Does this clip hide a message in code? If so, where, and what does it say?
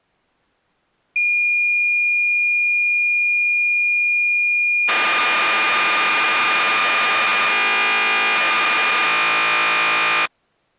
Yes: cassette data (Kansas City type), 1200 baud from 1.2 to 10.3 s, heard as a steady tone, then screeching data.